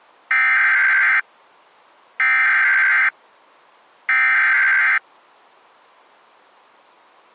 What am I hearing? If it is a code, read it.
Emergency Alert System (SAME) tones (header bursts), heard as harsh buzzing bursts, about 520.83 baud.